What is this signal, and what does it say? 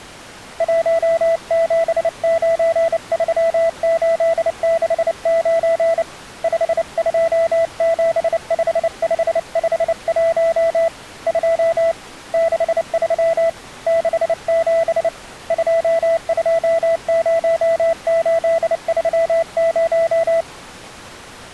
Morse code, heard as a keyed tone, hand-sent with a bug key, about 29 wpm, 660 Hz. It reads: 1793869 5275551 2 63 67 220830